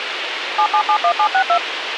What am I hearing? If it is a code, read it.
DTMF, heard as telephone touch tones, dialled by machine, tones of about 80 ms, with radio hiss. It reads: 7771762